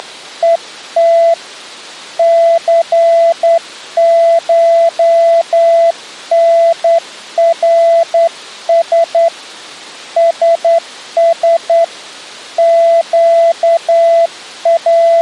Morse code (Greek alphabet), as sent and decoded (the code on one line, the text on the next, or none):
… / -.-. ---- -. .-. ... / ... ... / …
… ΘΧΝΡΣ ΣΣ …